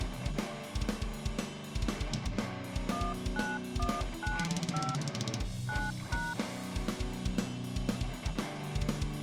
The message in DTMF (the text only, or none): 19195 9#